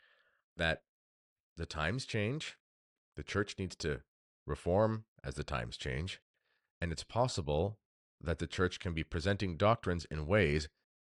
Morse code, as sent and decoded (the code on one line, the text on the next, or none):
none